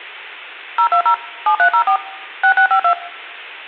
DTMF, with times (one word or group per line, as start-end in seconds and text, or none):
0.8-1.1 020
1.5-2.0 7304
2.4-2.9 6652